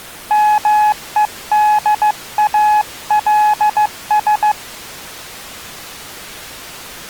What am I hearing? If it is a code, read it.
Morse code, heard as a keyed tone, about 15 wpm, 840 Hz. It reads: MEDALS